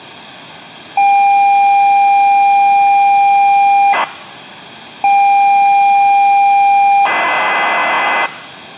ZX Spectrum tape loading, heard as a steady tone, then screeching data.